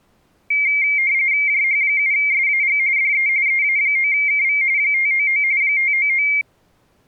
RTTY (45.45 baud, 170 Hz shift), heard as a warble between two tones, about 2200 Hz centre. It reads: JH7SAG DE EA9KV 599 599